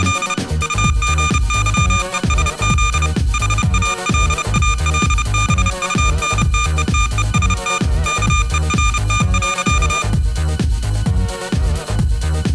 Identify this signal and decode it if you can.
Morse code, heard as electronic beeps, machine-sent, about 30 wpm, 1200 Hz, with room echo. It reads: … UGYESZ HALALBUNTETEST KERT.